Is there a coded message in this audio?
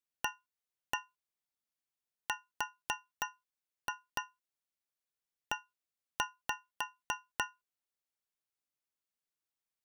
Yes: tap code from 0.2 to 7.6 s, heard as taps on a metal pipe, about 3 knocks a second. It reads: ARE